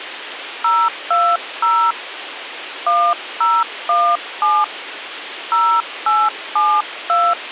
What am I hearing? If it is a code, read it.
DTMF, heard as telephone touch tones, dialled by hand, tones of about 250 ms, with radio hiss. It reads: 020 1017 0872